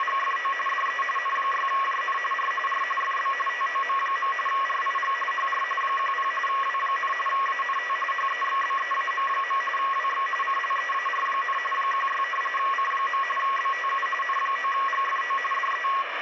RTTY (45.45 baud, 850 Hz shift), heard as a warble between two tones, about 1500 Hz centre, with radio static. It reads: … DE N6JN R R FB TOM. RIG HR 10 W, ANT HEXBEAM. WX CLEAR, 16 C. BTU N9GFO DE